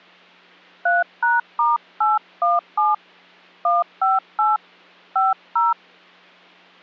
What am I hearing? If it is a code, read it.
DTMF, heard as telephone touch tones, dialled by hand, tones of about 180 ms. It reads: 3#*817 158 50